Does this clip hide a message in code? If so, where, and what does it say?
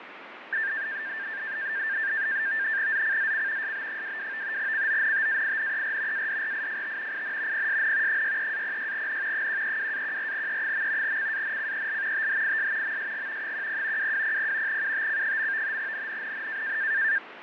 Yes: NAVTEX (SITOR-B), 100 baud, 170 Hz shift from 0.5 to 17.2 s, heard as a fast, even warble, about 1700 Hz centre, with radio static and fading. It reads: ZCZC SB22 CONTAINER ADRIFT IN PSN 63-06N 132-14E. CANCEL THIS MSG 10 2200 UTC. NNNN